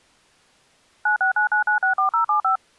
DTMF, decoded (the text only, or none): 9699964075